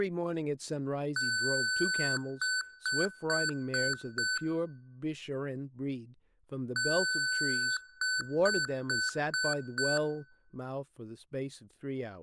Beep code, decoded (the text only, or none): 1 long, 5 short